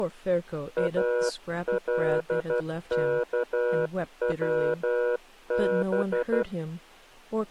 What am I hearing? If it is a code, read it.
Morse code (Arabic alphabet), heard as a keyed tone, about 12 wpm, 480 Hz, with speech in English. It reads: الكوب